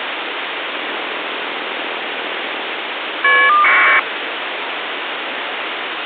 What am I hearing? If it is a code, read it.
Caller ID data burst, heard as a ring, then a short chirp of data, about 1200 baud, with phone line noise.